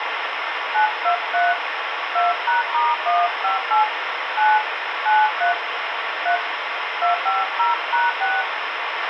DTMF, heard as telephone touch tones, dialled by hand, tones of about 150 ms, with radio hiss and a squelch burst at the end. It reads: 923 2#*158 9 93 3 250#6